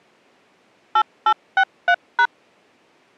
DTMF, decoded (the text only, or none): 8863#